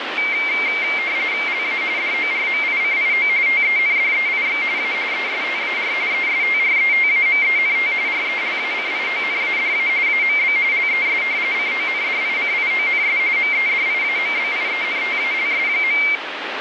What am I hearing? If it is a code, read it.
RTTY (45.45 baud, 170 Hz shift), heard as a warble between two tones, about 2200 Hz centre, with radio static. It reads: LA DORMICIO TENDEIX A ESTAR ESTRETAMENT RELACIONADA AMB LES CONDICIONS MEDIAMBIENTALS.